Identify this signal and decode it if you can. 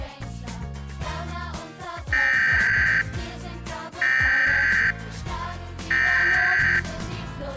Emergency Alert System (SAME) tones (header bursts), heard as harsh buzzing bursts, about 520.83 baud.